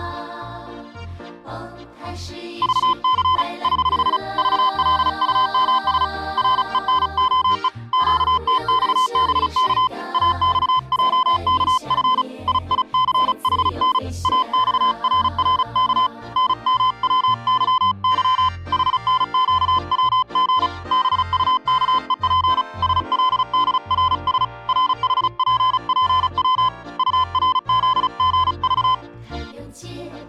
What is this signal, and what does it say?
Morse code, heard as a keyed tone, hand-sent with a paddle, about 35 wpm, 1020 Hz. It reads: VC <HH> VLUMS RENOE QTXBK AXJKF IICHN AXRRK NMWYY HNQWG BUKEP SLDRS RHPPW URZGV